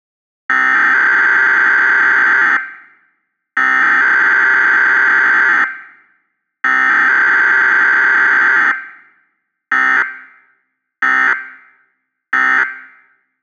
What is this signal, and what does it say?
Emergency Alert System (SAME) tones (header bursts, then end-of-message bursts), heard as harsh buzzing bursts, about 520.83 baud.